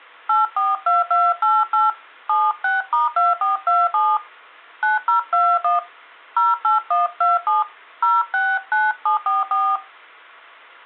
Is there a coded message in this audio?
Yes: DTMF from 0.3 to 9.8 s, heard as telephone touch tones, dialled by hand, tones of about 180 ms. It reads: 842288 76*2427 9021 08127 069744